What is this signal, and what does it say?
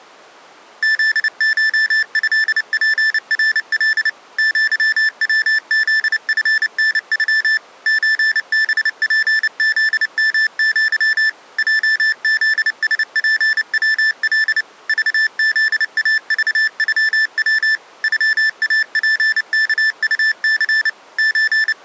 Morse code (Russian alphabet), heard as electronic beeps, machine-sent, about 29 wpm, 1750 Hz. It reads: ЗШЭПРЛ ЪВЗФНЮ ЧБПЗМЪ ЙЗСПВЛ ЖЗАЖЮВ ЮАПКУЦ …